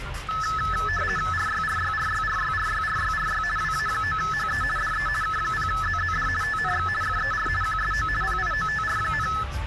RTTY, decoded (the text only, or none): RYRYRYRYRYRYRY WA9HE DE K0ZZD TNX FER QSO PIOTR,